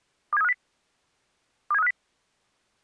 Five-tone selective call (EEA), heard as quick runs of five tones, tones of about 40 ms. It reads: 27350 27350